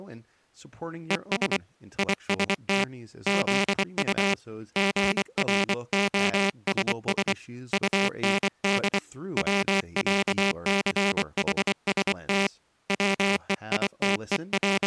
Morse code (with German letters), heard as a buzzer, hand-sent with a bug key, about 24 wpm, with speech in English. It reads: ES IST ZU GROSS UND WÄCHST …